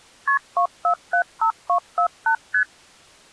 Multi-frequency trunk signalling (R1, as on North American trunks), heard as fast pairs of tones, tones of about 90 ms. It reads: KP 2475248 ST